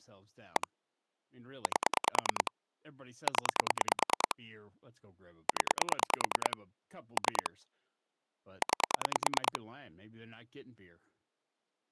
Pulse dialling, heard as clicks on a phone line, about 9 pulses a second, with speech in English. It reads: 1 8 0 0 3 9